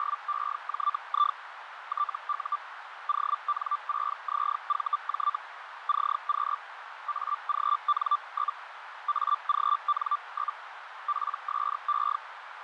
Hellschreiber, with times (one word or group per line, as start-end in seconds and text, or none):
0.0-1.4 …
1.9-2.6 TU
3.1-5.4 ON6ZVJ
5.9-6.6 CQ
7.1-8.6 AGN?
9.1-10.6 AGN?
11.1-12.2 PSE